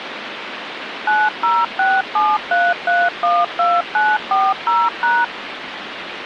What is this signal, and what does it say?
DTMF, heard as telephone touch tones, dialled by machine, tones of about 220 ms, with phone line noise. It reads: 90673312940#